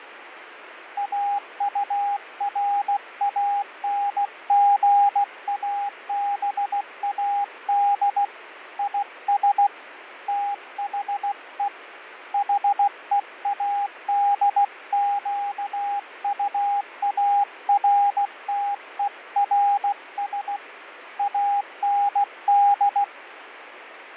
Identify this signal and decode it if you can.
Morse code, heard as a keyed tone, hand-sent with a paddle, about 16 wpm, 810 Hz, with radio static and fading. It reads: AURANGABAD IS THE HEADQUARTERS AND